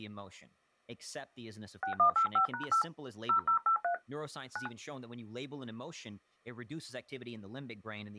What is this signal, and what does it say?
DTMF, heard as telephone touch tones, dialled by hand, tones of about 100 ms, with speech in English. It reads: 6185#8 0083 9